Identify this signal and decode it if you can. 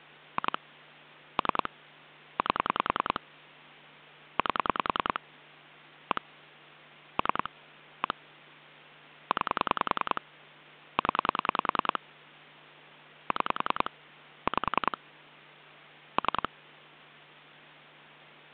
Pulse dialling, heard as clicks on a phone line, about 10 pulses a second, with hum. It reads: 2 3 8 8 1 3 1 9 0 6 5 3